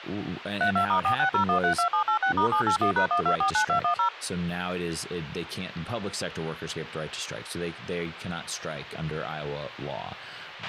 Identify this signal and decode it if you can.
DTMF, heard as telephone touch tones, dialled by machine, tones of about 100 ms, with a squelch burst at the end and speech in English. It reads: 32*460132786*781#1249210